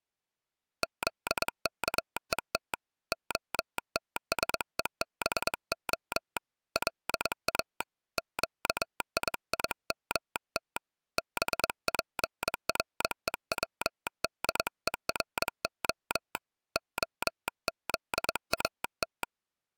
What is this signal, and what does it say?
Morse code (Hebrew alphabet), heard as a telegraph sounder, hand-sent with a straight key, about 22 wpm. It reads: זכות התשובה לא קיימת בפרוצדורה הזאת